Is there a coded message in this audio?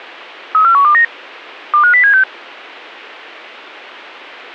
Yes: five-tone selective call (CCIR) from 0.5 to 2.2 s, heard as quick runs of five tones, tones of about 100 ms. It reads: 34129 25076